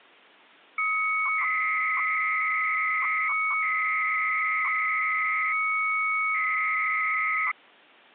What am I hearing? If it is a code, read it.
300-baud modem data (Bell 103 tones), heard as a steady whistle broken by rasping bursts, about 300 baud, 200 Hz shift.